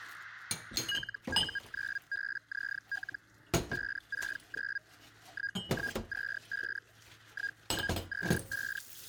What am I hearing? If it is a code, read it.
Hellschreiber (Feld-Hell, 122.5 baud), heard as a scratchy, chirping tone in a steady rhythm, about 1650 Hz, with kitchen noise. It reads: LU9BZL 569 1125 1125